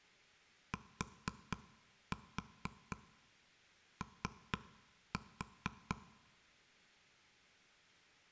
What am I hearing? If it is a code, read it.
Tap code, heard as taps on a table, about 4 knocks a second. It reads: TO